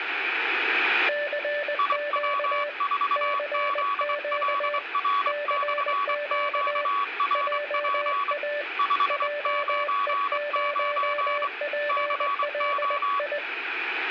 Morse code, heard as two keyed tones, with room echo. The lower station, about 20 wpm, 590 Hz: CQ CQ CQ JA JE0PLI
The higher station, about 24 wpm, 1130 Hz: IW4ZLR/QRP 599 CO